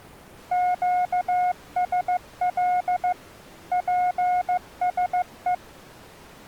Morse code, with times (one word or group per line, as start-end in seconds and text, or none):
0.5-3.1 QSL
3.7-5.5 PSE